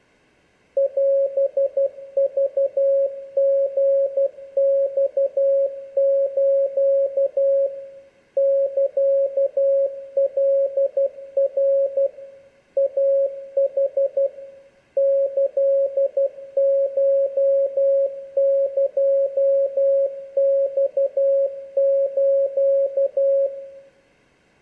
Morse code (Japanese Wabun code), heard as a keyed tone, machine-sent, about 12 wpm, 550 Hz, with room echo. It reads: オクリマス サカナ イヌ キコエマス